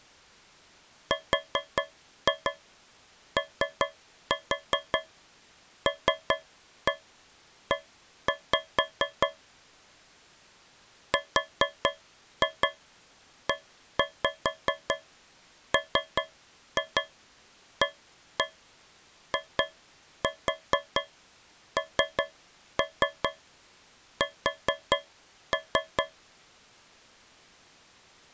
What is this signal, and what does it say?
Tap code, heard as taps on a metal pipe, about 5 knocks a second. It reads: ROLE REMAINS